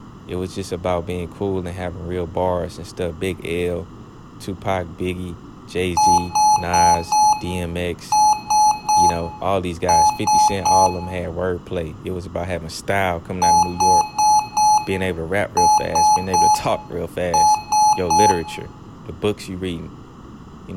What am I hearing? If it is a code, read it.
Beep code, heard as beeps from a small speaker, played twice, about 850 Hz, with room echo and speech in English. 4-3-3. In Phoenix BIOS tables: timer channel 2 failure.